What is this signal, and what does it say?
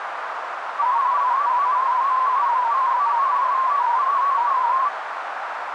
Multi-tone FSK (Olivia or MFSK type), about 250 Hz wide, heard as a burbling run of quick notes, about 31.25 baud, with radio static and a narrow filter.